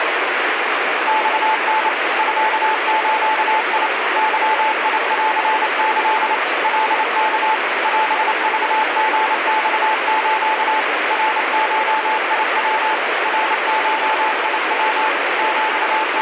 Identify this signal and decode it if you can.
Morse code (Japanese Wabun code), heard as a keyed tone, machine-sent, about 28 wpm, 870 Hz, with heavy radio static. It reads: マタ ミズ ゲンキ カワ オクリマス ナゴヤ ナゴヤ …